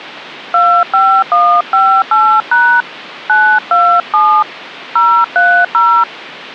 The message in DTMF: 25158# 927 030

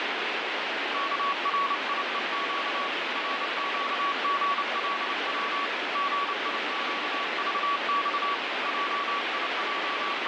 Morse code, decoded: KRIEQ RQGLW GIQVX …

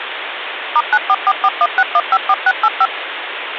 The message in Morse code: none

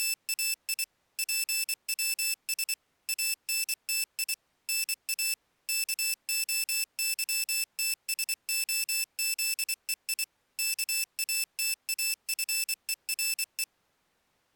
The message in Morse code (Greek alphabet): … ΠΩΣ ΑΝΤΙ ΝΑ ΚΟΥΤΣΟΖΕΙ ΚΑΤΑΦΕΡΕ

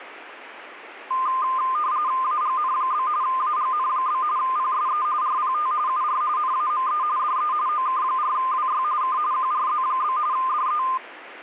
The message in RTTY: AGN? AGN? PSE RPT UR NAME DE OK4WY K QRZ? DE

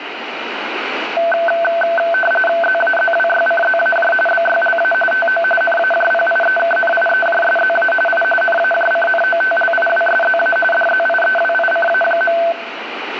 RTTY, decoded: ZAZWYCZAJ BYLA TO NAJPIEKNIEJSZA I NAJCNOTLIWSZA DZIEWICA.

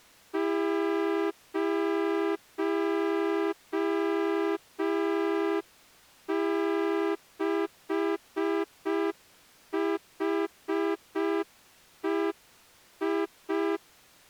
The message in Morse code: 06HEI

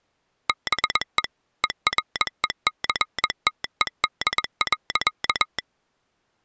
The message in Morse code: BE ERECTED.

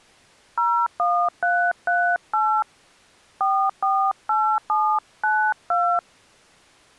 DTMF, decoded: 01338 448792

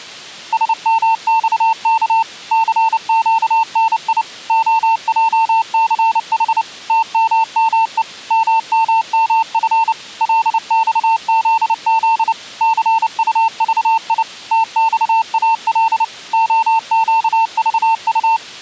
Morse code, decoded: SMXK CQNI OJCH TMME MMMF LXZZ CUVI TXAL OQVU

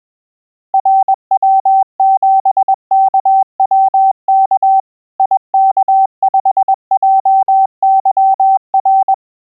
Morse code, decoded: RW7KWK IK5JYR

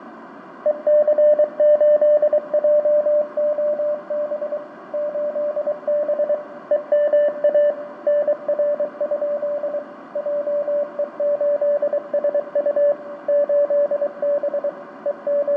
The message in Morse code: EC8JOB 8B EMA NR? JE8SU 8B …

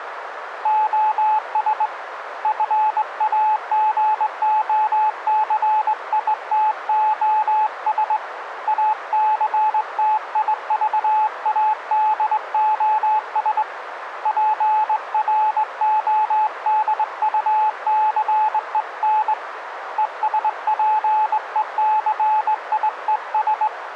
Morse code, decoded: OS FAGOCITOS ACTIVADOS PRODUCEN ESPECIES

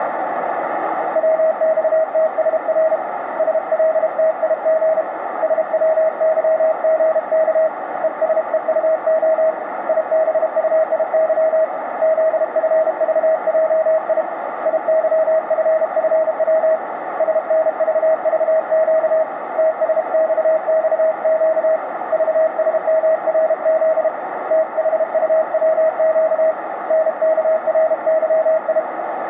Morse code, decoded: WXTSR SLTIG SWYGK ESEUO IBUIY ZFVJI IYFFW SNVVQ TSXXQ VSMRZ THUWQ NKRYI

